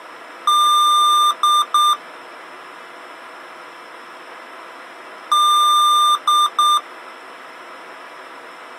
Beep code, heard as beeps from a small speaker, played twice, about 1200 Hz. 1 long, 2 short. In Award, IBM and AMI BIOS tables: video adapter failure.